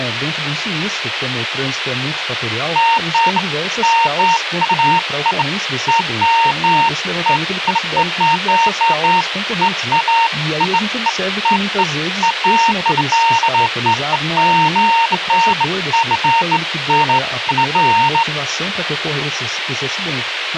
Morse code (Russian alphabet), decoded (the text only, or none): none